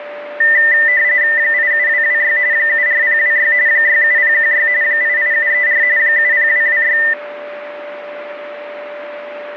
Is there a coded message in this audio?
Yes: RTTY (45.45 baud, 170 Hz shift) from 0.4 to 7.1 s, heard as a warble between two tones, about 1900 Hz centre, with radio static and a steady whistle near 590 Hz. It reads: 87226 74026 67016 88734 70226